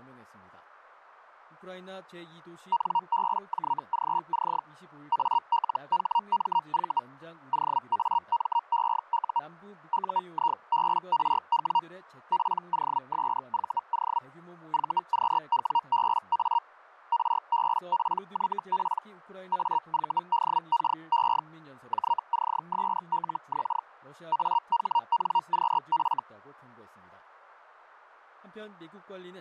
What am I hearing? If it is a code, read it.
Hellschreiber (Feld-Hell, 122.5 baud), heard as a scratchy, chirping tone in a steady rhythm, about 940 Hz. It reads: NBJGC ALHMV OAMEU UIBRW POSVO VQWBA RBPYP AVDKE JCSLX AHNQF